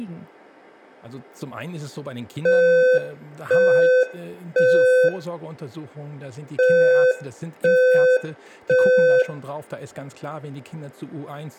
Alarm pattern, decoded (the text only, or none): temporal three